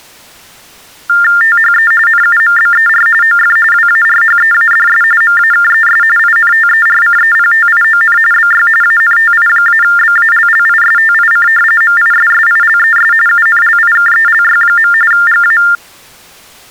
TTY/TDD text telephone tones (45.45 baud Baudot), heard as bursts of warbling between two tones, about 400 Hz shift, 1600 Hz centre. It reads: THE NUMBER OF WARHEADS MAKES INTERCEPTION BY ANTI-BALLISTIC MISSILES UNLIKELY. GA